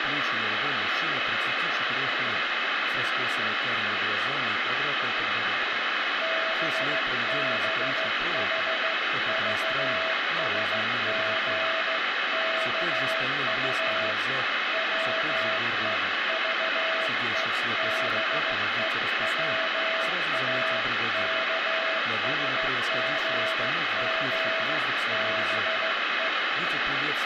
Morse code (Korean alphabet), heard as a keyed tone, hand-sent with a straight key, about 15 wpm, 650 Hz, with heavy radio static. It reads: 뚜렷이 바라다보였다